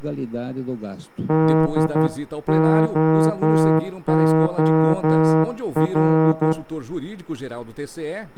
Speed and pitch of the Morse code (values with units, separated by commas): 11 wpm